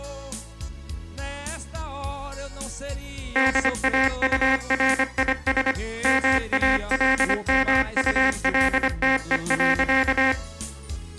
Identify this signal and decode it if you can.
Morse code, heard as a buzzer, machine-sent, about 25 wpm. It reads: DAURIS MALMULTE.